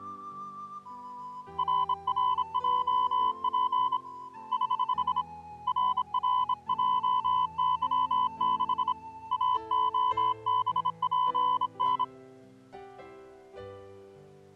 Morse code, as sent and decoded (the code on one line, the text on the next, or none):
.-. .-. .--- .--. / ........ / .-. .-. .--- -.-- -.... / .- --- -... .--. -.
RRJP <HH> RRJY6 AOBPN